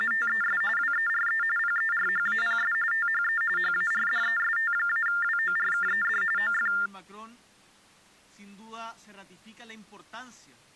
TTY/TDD text telephone tones (45.45 baud Baudot), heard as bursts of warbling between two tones, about 400 Hz shift, 1600 Hz centre. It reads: … WERE PERHAPS THE HARDEST-WORKED OF